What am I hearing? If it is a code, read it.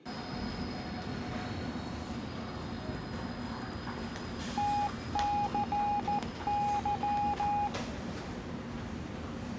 Morse code, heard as a keyed tone, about 14 wpm, 820 Hz, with the noise of a subway station. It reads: TCY